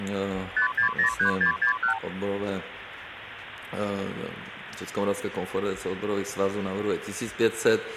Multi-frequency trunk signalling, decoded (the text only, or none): 5603661